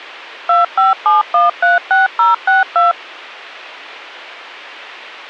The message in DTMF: 257136062

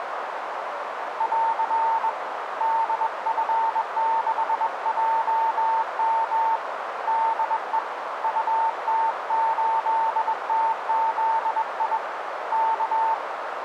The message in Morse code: <AR> DF6JM DE UT8TZI K

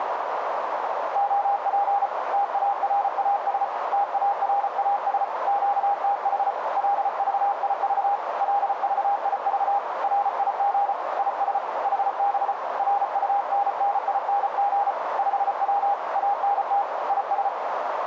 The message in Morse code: OP TARAS TARAS QTH LVIV LVIV RIG IS HB RUNNING 5W ANT IS

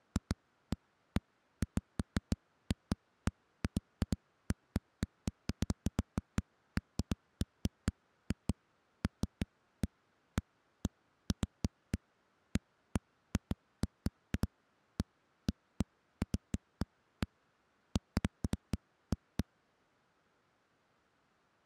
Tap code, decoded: none

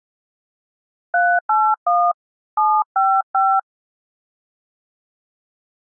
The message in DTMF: 381 755

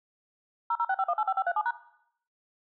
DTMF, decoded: 0065185537#

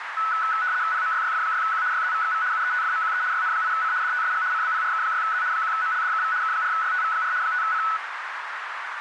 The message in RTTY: PMYYF6Q YZVXV UETFMQE YN8C DTSG CBPRK6Z 1MLDKV K4YTV4 5C

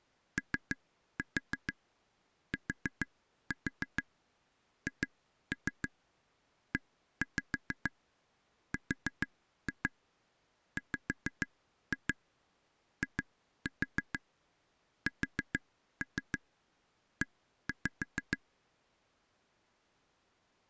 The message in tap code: OTHERWISE

